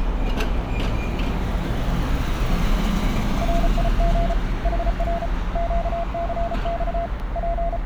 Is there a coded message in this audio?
Yes: Morse code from 3.4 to 7.9 s, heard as a keyed tone, hand-sent with a paddle, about 34 wpm, 680 Hz, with radio static and street noise. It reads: RIG HR QCX …